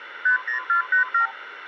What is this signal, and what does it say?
Multi-frequency trunk signalling (R2, with the far end's replies), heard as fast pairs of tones, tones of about 110 ms, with phone line noise. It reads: 50487